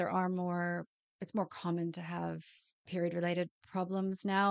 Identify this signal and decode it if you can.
Speech in English. There is no code.